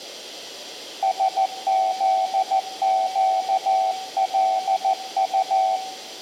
Morse code, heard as a keyed tone, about 14 wpm, 760 Hz, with room echo. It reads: SZQLU